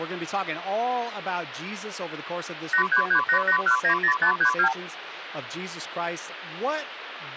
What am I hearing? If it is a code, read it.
Multi-frequency trunk signalling (R2, with the far end's replies), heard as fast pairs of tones, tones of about 90 ms, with phone line noise. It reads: 83388190532